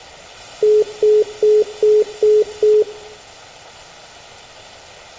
Telephone call progress tone (single-tone plan, as in most of Europe), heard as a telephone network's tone, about 420 Hz, 0.2 s on and 0.2 s off, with room echo. Congestion tone.